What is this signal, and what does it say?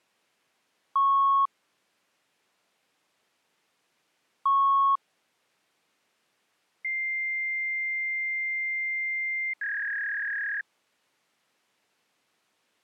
Fax machine handshake, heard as beeps, a long tone and a warble.